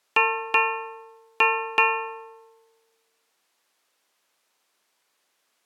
Ship's bell, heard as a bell. 4. Four half-hours of the watch have passed.